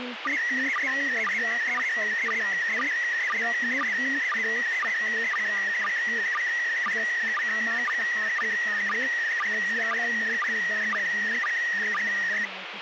SSTV (slow-scan television), PD 120, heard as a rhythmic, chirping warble, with radio hiss and speech in Nepali.